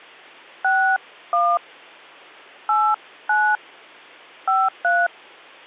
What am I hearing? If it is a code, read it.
DTMF, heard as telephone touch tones, dialled by hand, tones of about 240 ms. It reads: 61 89 53